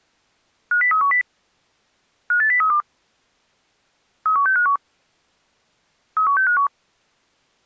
Five-tone selective call (CCIR), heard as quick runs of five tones, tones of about 100 ms. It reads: 50310 58032 31651 31651